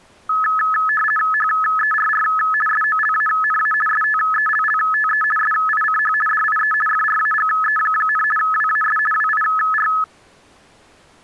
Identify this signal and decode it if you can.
RTTY (50 baud, 450 Hz shift), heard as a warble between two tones, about 1500 Hz centre. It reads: HERR SOLANA STELLTE SICH DIE FRAGE, WAS WIR